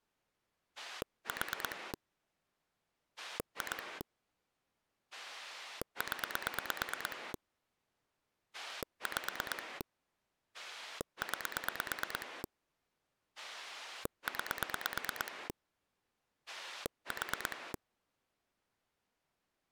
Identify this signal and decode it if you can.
Pulse dialling, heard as a rotary dial, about 9 pulses a second. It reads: 4 2 0 5 9 9 4